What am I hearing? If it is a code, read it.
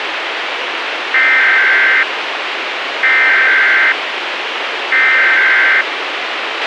Emergency Alert System (SAME) tones (header bursts), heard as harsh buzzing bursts, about 520.83 baud, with radio hiss and a squelch burst at the end.